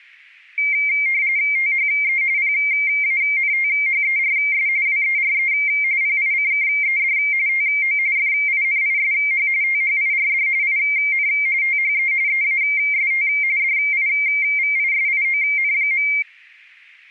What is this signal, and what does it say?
RTTY (45.45 baud, 170 Hz shift), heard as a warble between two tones, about 2200 Hz centre, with static crashes. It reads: THE PANTHERS WERE PICKED TO FINISH THIRD IN THE EAST DIVISION.